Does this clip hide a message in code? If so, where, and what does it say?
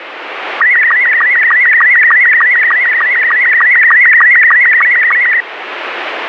Yes: SSTV (slow-scan television), Robot 72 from 0.6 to 5.4 s, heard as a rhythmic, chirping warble, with radio static.